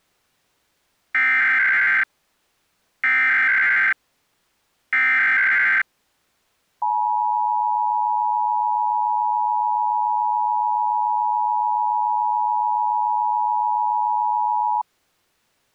Emergency Alert System (SAME) tones (header bursts, then the 853 and 960 Hz attention tone), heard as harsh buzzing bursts, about 520.83 baud.